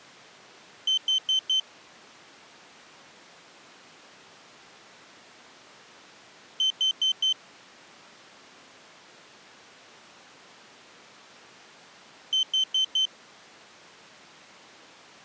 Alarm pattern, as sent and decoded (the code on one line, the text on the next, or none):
4 beeps and a pause
temporal four